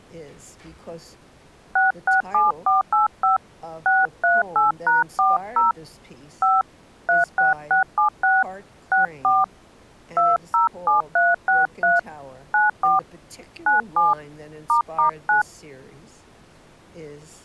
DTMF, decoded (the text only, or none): 667485 638#40 5 36676 64 207363 94 97 **9